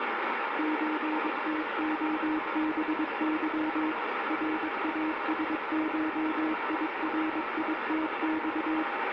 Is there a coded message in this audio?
Yes: Morse code (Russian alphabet) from 0.5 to 8.9 s, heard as a keyed tone, machine-sent, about 22 wpm, 310 Hz, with heavy radio static. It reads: ЧТОБЫ РАСШИРИТЬ